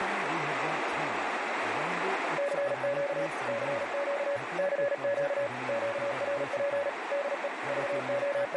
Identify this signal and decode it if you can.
Morse code, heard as a keyed tone, machine-sent, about 37 wpm, 570 Hz, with radio static, a narrow filter and speech in Nepali. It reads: CQ CQ CQ QRP DE …